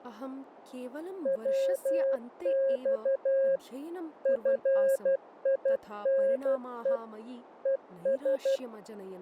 Morse code, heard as a keyed tone, machine-sent, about 12 wpm, 540 Hz, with speech in Sanskrit. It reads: WX FINE ES